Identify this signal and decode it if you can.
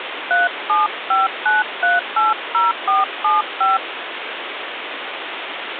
DTMF, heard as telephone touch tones, dialled by hand, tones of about 170 ms, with phone line noise. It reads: 3759380475